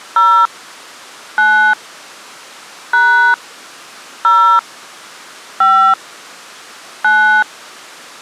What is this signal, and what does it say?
DTMF, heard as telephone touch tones, dialled by hand, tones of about 290 ms. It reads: 0 9 # 0 5 9